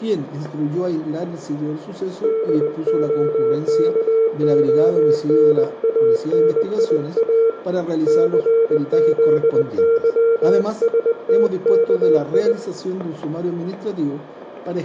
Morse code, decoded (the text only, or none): DOKONANIA CZYSTKI